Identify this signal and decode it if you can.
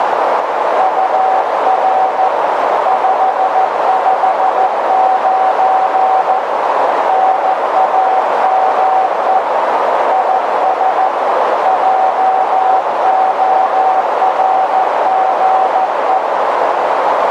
Morse code, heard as a keyed tone, hand-sent with a paddle, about 14 wpm, 760 Hz, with heavy radio static and a narrow filter. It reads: UR 559 NAME IS JORGE